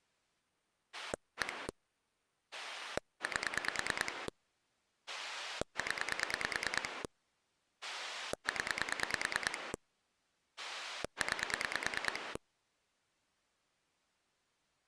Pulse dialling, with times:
0.9-1.7 1
2.5-4.3 8
5.1-7.0 0
7.8-9.7 0
10.6-12.4 9

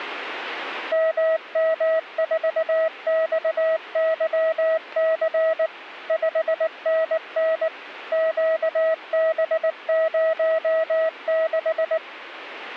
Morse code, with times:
0.9-5.7 MM4XYC
6.1-7.7 5NN
8.1-12.0 QB06

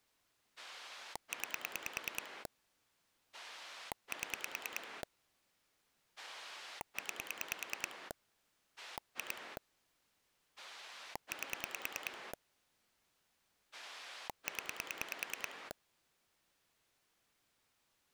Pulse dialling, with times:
0.6-2.5 9
3.3-5.0 7
6.2-8.1 9
8.8-9.6 2
10.6-12.3 8
13.7-15.7 0

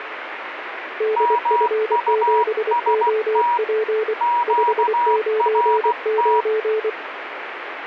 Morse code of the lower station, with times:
1.0-4.1 DF7OP
4.5-6.9 599

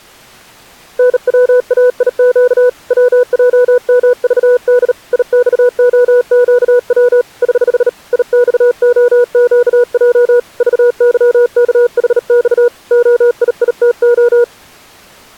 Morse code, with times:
1.0-2.7 NWAIQ
2.9-4.9 WJMVD
5.1-7.2 IXOQW
7.4-7.9 <HH>
8.1-10.4 IXOQJ
10.6-12.7 VYKHX
12.9-14.4 OIITO

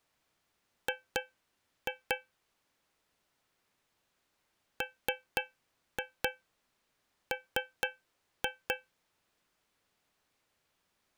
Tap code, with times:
0.9-2.2 G
4.8-8.7 MM

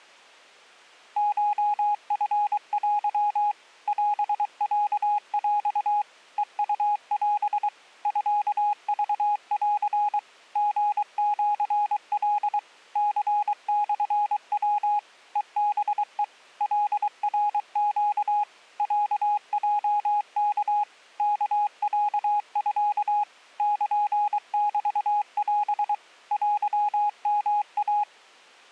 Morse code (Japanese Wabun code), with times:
1.2-3.5 コチテ
3.9-6.0 オロヰ
6.4-7.7 ヘウオ
8.1-10.2 ミクン
10.6-12.6 リシカ
13.0-15.0 ニモヤ
15.4-16.2 ヘハヘ
16.6-18.4 カナネ
18.8-20.8 ロヲワ
21.2-23.2 ワロミ
23.6-25.9 ルメオ
26.3-28.0 テヨイ

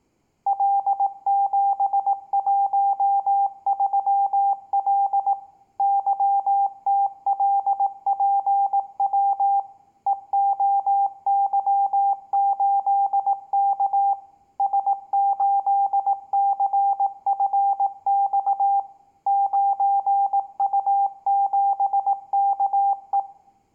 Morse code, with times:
0.5-5.3 L713L
5.8-9.6 YTLPW
10.1-14.1 EOY8K
14.6-18.8 S8CFX
19.3-23.2 9U7KE

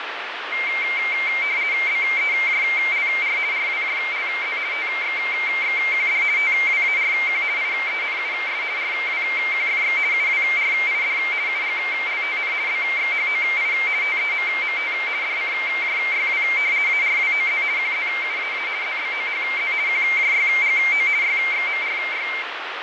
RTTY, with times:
1.9-3.4 BEJLR
3.5-4.6 RWJLZ
4.7-6.2 TXXQD
6.4-7.4 TWARQ
7.6-8.6 IENUS
8.8-10.0 RWQFX
10.1-11.2 UWRID
11.5-12.5 UGLTN
12.7-13.7 BXHOI
14.0-14.9 TEMMT
15.2-16.4 DCJYW
16.9-17.6 ARWOZ
17.8-18.7 QZUAA
18.8-19.7 ZBOHZ
19.9-21.1 QJYGO
21.2-22.3 YXMRY

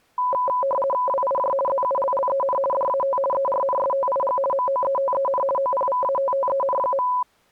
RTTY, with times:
1.1-1.5 WIJ
1.7-2.6 ZULLEN
2.7-3.2 DAT
3.3-4.4 ERNSTIG
4.5-5.4 MOETEN
5.6-7.1 OPVATTEN.

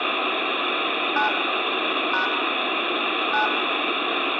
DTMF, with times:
1.2-1.3 9
2.1-2.3 #
3.3-3.5 9

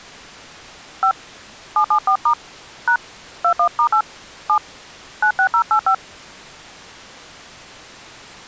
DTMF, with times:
1.0-1.1 5
1.8-2.3 774*
2.9-3.0 #
3.4-4.0 21*8
4.5-4.6 7
5.2-5.9 96085

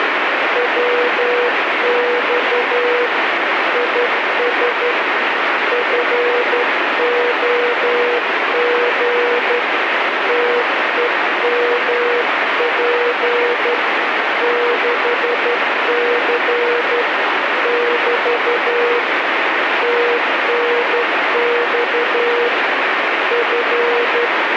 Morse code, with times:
0.6-3.1 WX
3.7-4.9 IS
5.7-9.6 FOG
10.3-13.7 TEMP
14.4-17.0 6C
17.7-19.0 <BT>
19.8-22.5 TNX
23.3-24.6 …

